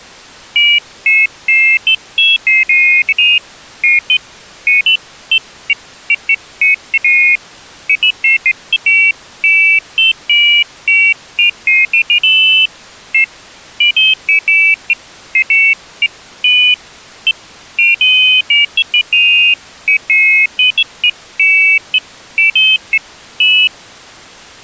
Pairs of high tones at irregular times. There is no code.